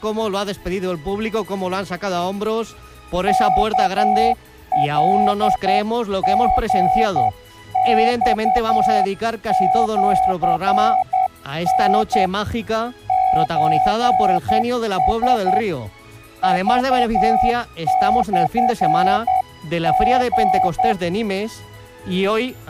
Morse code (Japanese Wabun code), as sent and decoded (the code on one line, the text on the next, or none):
-.- .-.. --. -..- --.-. -. / ---. ... / ...- -..-. --.
ワカリマシタ ソラ クモリ